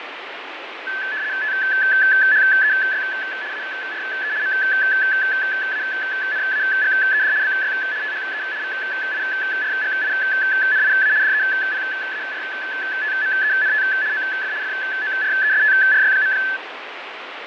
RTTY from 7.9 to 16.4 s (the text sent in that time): THE VIRGINIA DEPARTMENT OF FORESTRY.